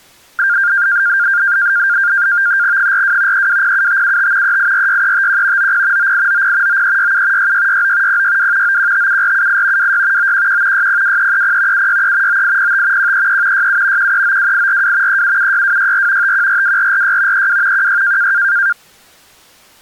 NAVTEX (SITOR-B), 100 baud, 170 Hz shift, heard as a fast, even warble, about 1500 Hz centre. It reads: 42 3207575 3846351 90 9890 9367 6669 062 9157478 26 911 602330 763 9805 133 67 1392842 3776264 5142446 32 16